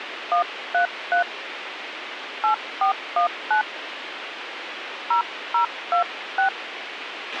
DTMF, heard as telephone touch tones, dialled by hand, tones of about 110 ms, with radio hiss and a squelch burst at the end. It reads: 133 8419 0026